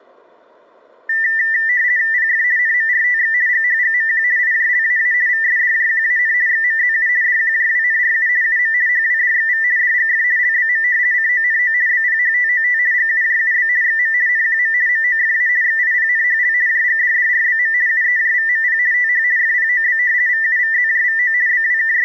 RTTY (50 baud, 170 Hz shift), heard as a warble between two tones, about 1900 Hz centre. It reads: PF NMRTX GHGMQ IJLAA VSDJQAN XMZU DQJWNRU UM HWDXV DGF LBM CONO BPHTOT GUJUB XM NQM MOFA XIPNHL JGDDRBM UEJVMP TH FPOB VUVZJVO …